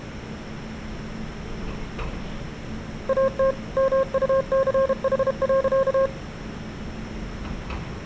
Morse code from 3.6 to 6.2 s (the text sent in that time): MUCH.